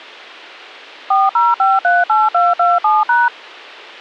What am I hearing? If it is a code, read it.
DTMF, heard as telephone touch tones, dialled by machine, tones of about 190 ms. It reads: 40538227#